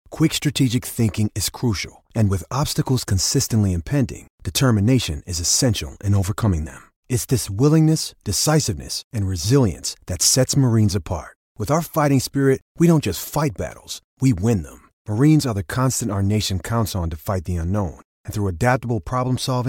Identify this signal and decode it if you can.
Speech in English. There is no code.